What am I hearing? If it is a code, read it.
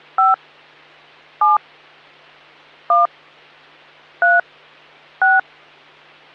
DTMF, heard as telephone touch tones, dialled by hand, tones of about 160 ms, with hum. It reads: 5 7 1 3 6